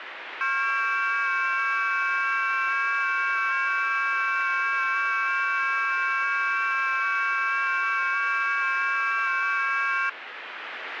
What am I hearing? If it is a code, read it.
FT8 (several signals at once), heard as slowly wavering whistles, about 6.25 baud, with radio static.